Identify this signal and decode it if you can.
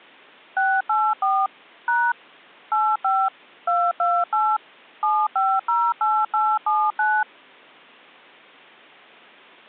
DTMF, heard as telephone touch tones, dialled by machine, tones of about 240 ms. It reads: 684 # 85 228 7508879